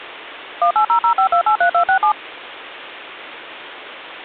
DTMF, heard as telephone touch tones, dialled by machine, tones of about 90 ms. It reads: 18005283267